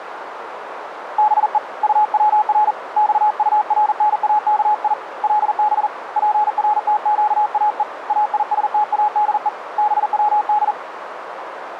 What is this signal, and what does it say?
Morse code (Persian alphabet), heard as a keyed tone, hand-sent with a paddle, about 40 wpm, 840 Hz, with radio static and a narrow filter. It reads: به طور خطرناکی لب پرتگاه ایستاده بود